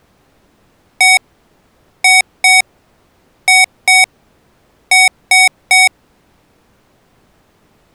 Beep code, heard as beeps from a small speaker, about 750 Hz. 1-2-2-3. In Phoenix BIOS tables: BIOS ROM checksum failure.